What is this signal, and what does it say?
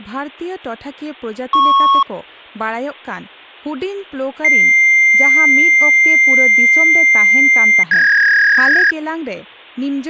Fax machine handshake, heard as a beep, a long tone and a warble, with speech in Santali.